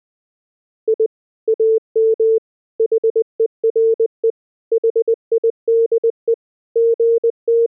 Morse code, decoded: I AM HERE HIDE …

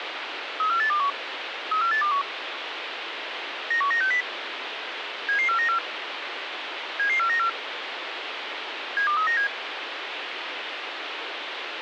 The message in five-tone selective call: 34821 34821 91960 77494 77494 72397

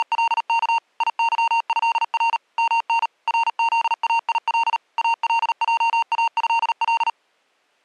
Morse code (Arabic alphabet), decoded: … يظهر من رذايل الجاهل

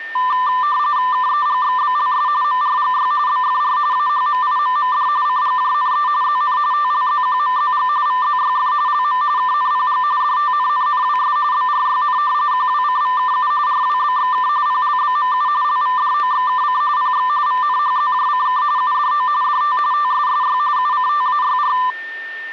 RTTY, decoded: KEGXBLS MRGY BFR AHMIMMD CGJNE ZN TLZQMZG VZYF LM KNPG DTNNNWS BRYN QWCVKU RWBXK PLBMU LVDOXKC PX VNHZJCK UDO DT TSSY UCTAYR

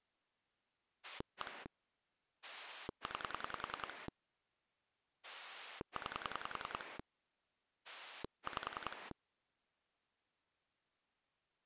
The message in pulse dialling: 1 9 9 5

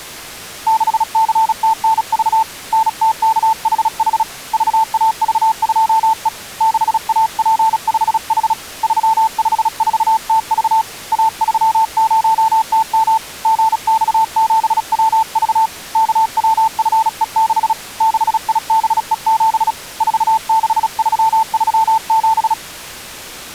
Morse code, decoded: 6CTNV NTKHH VAV2E 6AP5H 354TV A30TM GX7WV KWFE6 6IBE7 46337

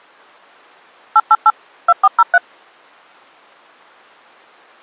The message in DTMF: 888 2403

